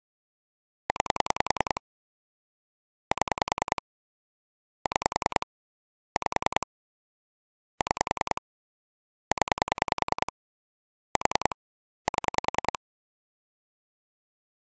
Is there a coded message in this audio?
Yes: pulse dialling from 0.9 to 12.8 s, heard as clicks on a phone line, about 10 pulses a second. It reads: 9 7 6 5 6 0 4 7